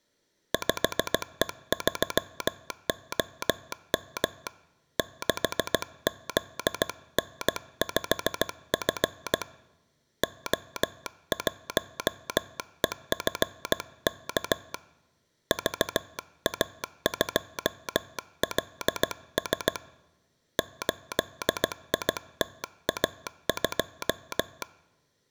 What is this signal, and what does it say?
Morse code, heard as a telegraph sounder, hand-sent with a paddle, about 16 wpm. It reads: 5E3OM 6ZN5F O1EFK VA2LS 8ITA2